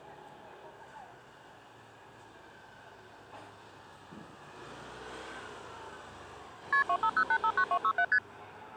Multi-frequency trunk signalling (R1, as on North American trunks), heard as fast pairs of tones, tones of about 70 ms, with the noise of a residential street. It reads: KP 250859267 ST